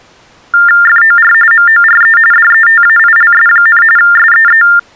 TTY/TDD text telephone tones (45.45 baud Baudot), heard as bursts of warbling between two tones, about 400 Hz shift, 1600 Hz centre. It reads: FOR MORE DETAILS, SEE